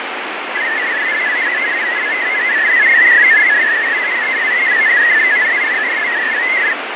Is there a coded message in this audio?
Yes: multi-tone FSK (Olivia or MFSK type), about 500 Hz wide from 0.5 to 6.8 s, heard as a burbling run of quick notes, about 62.5 baud, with radio static and fading.